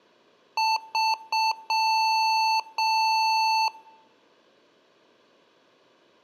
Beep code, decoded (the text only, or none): 3 short, 2 long